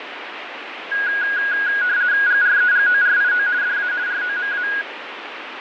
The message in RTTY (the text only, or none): GREGORIO DA ROMA